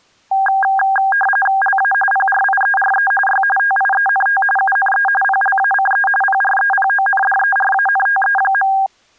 RTTY (45.45 baud, 850 Hz shift), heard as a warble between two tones, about 1200 Hz centre. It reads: LA PRIERE Y TIENT UNE PLACE PREPONDERANTE.